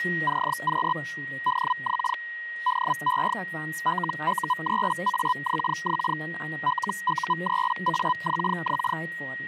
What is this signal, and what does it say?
Hellschreiber (Feld-Hell, 122.5 baud), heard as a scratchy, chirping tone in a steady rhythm, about 1000 Hz, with static crashes, a steady whistle near 1890 Hz and speech in German. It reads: CQ DX DE LU3AXX LU3AXX